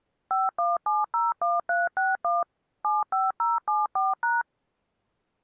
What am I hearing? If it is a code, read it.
DTMF, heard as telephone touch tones, dialled by machine, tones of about 180 ms. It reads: 51701361 75074#